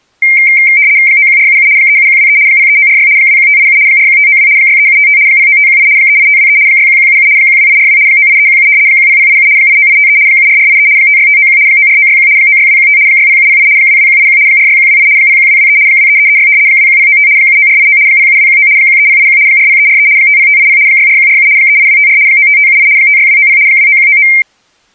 RTTY (75 baud, 170 Hz shift), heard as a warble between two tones, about 2200 Hz centre. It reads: 91477 37123 03946 21587 41592 63755 09518 38523 61177 12842 98317 10087 89853 74483 56591 94961 96215 60708 22181 46128 01223 23336 21095 79489 07219 13081 40343 50580 64147 38254 95578 56290 29199